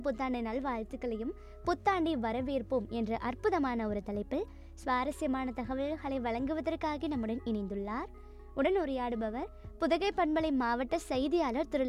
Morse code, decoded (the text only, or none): none